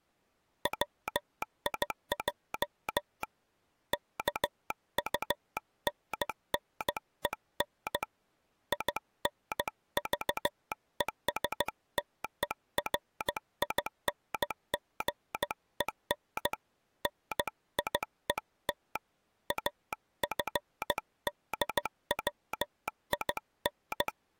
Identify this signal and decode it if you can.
Morse code, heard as a telegraph sounder, hand-sent with a paddle, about 15 wpm. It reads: WIJ KUNNEN INVESTERINGEN NIET …